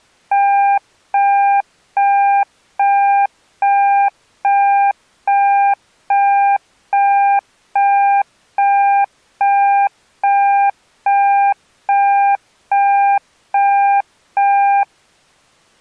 Evenly repeated beeps. There is no code.